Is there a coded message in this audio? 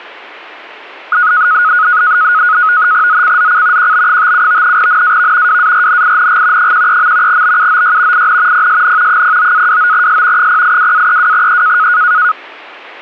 Yes: NAVTEX (SITOR-B), 100 baud, 170 Hz shift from 1.1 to 12.3 s, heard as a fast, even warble, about 1360 Hz centre, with static crashes. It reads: ZCZC QB57 NAV WARNING 13. BUOY IN PSN 09-29S 082-32E